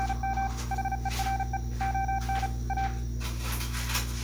Morse code, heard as a keyed tone, machine-sent, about 35 wpm, 780 Hz, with room echo and kitchen noise. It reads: … HERE ON A